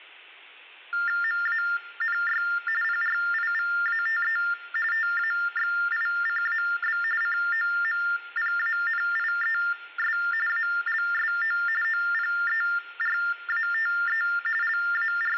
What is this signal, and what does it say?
TTY/TDD text telephone tones (45.45 baud Baudot), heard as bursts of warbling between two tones, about 400 Hz shift, 1600 Hz centre, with room echo. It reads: MANY PRIVATE TAXICAB COMPANIES ALSO OPERATE …